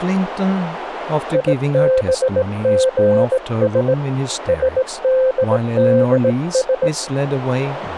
Morse code (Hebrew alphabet), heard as a keyed tone, hand-sent with a straight key, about 18 wpm, 520 Hz, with radio static and speech in English. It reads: יבגש שדדש